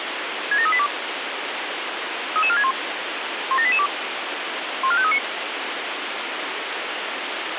Five-tone selective call (ZVEI), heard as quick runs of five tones, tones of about 70 ms, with radio hiss. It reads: 67382 33461 17882 14539